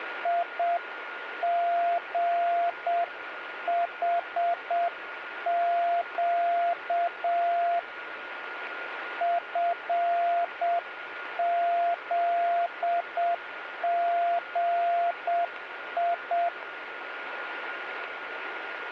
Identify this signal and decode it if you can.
Morse code, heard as a keyed tone, hand-sent with a paddle, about 7 wpm, 690 Hz, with radio static and a steady whistle near 1430 Hz. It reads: IGHQ FZGI